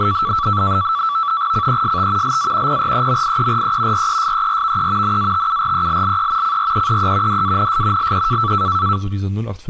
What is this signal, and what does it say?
NAVTEX (SITOR-B), 100 baud, 170 Hz shift, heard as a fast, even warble, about 1230 Hz centre, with speech in German. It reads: CEST LA PREMIERE RESERVE NATURELLE CREEE DANS LE